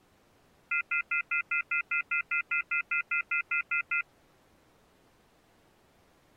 Telephone call progress tone (North American plan), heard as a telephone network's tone, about 1400, 2050, 2450, 2600 Hz, 0.1 s on and 0.1 s off. Off-hook warning tone.